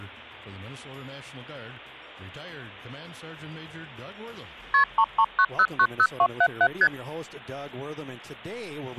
Multi-frequency trunk signalling (R1, as on North American trunks), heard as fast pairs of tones, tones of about 60 ms. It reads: KP 339090277 ST